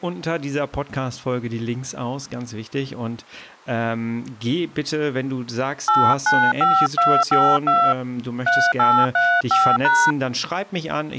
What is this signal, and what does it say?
DTMF, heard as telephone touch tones, dialled by hand, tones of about 260 ms, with speech in German. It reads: 895252 3835#